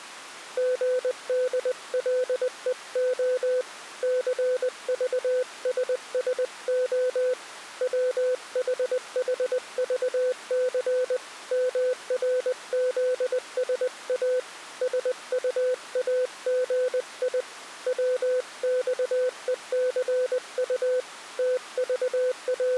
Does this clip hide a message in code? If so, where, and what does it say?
Yes: Morse code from 0.5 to 22.8 s, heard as a keyed tone, hand-sent with a paddle, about 20 wpm, 500 Hz. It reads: GDLEO CVSSO WHHVC MRZSA SUAGI WXECU …